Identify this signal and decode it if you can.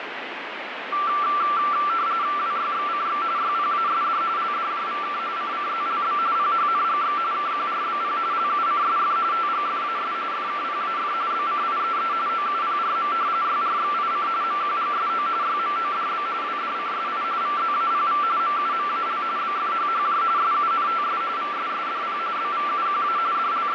RTTY (45.45 baud, 170 Hz shift), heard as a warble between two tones, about 1260 Hz centre, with radio static. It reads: WYXCX YPASD LDJVK CCZLB PHNGX KQRBP LUCSF TGFAS FKPAF BCIEE OUPRM YRXIC MQGSO YMODB WDCSI VZAPV MUMAL BFHHJ SUNTS VSSDP BVUQA …